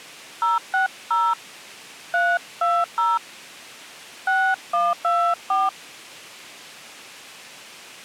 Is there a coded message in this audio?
Yes: DTMF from 0.4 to 5.7 s, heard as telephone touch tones, dialled by hand, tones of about 230 ms. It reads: 060 320 6124